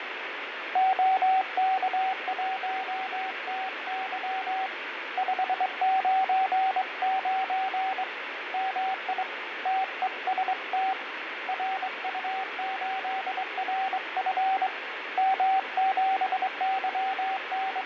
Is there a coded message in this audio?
Yes: Morse code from 0.7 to 17.9 s, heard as a keyed tone, hand-sent with a straight key, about 23 wpm, 760 Hz, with radio static and fading. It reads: OK1TY 599 MI TEST RU8RF …